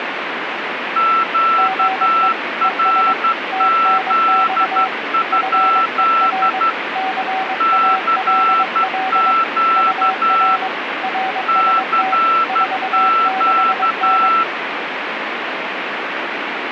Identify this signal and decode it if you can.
Morse code, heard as two keyed tones, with radio static. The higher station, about 12 wpm, 1340 Hz: QRZ? CQ CQ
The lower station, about 22 wpm, 760 Hz: GE ES TNX FER CALL UR RST 46N